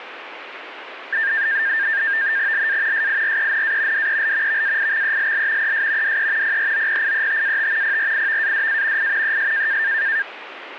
NAVTEX (SITOR-B), 100 baud, 170 Hz shift, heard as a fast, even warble, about 1700 Hz centre, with radio static. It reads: LA SIRENA DEL VAIXELL ES DE PROPIETAT PRIVADA I ES